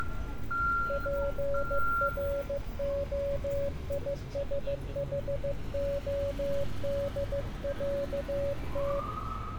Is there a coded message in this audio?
Yes: Morse code (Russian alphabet) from 0.8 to 9.1 s, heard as a keyed tone, hand-sent with a paddle, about 15 wpm, 560 Hz, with room echo and street noise. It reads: ПРОИСХОДЯТ